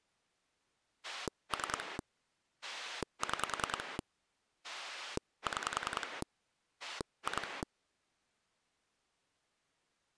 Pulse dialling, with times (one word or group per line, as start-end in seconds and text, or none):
1.0-2.0 3
2.6-4.0 6
4.6-6.2 6
6.8-7.6 2